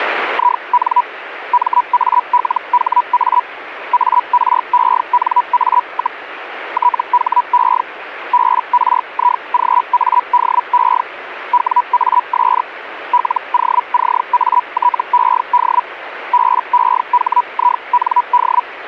Hellschreiber (Feld-Hell, 122.5 baud), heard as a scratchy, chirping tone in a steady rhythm, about 980 Hz, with radio static. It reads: IN MALHA ARENA, THE BRIGADE WAS LOCATED BEHIND